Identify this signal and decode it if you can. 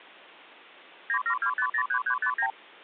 Multi-frequency trunk signalling (R2, with the far end's replies), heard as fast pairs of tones, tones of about 80 ms. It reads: 972503359